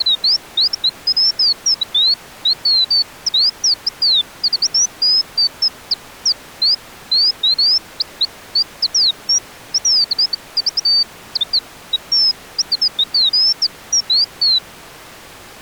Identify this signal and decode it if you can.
Bird-like chirps. There is no code.